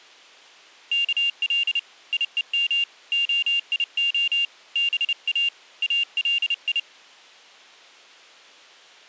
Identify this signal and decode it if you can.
Morse code (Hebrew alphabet), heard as a high beeper, hand-sent with a paddle, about 30 wpm, 2800 Hz. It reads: כל יום היה בא אלי